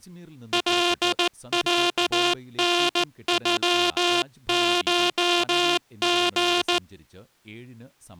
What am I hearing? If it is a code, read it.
Morse code (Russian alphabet), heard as a buzzer, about 15 wpm, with speech in Malayalam. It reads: ЛЯНЮШГ